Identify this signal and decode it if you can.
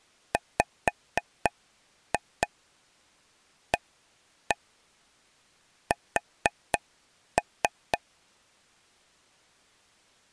Tap code, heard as taps on a table, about 4 knocks a second. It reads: WAS